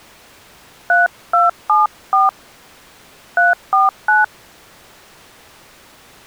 DTMF, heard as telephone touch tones, dialled by hand, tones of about 160 ms. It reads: 3274 349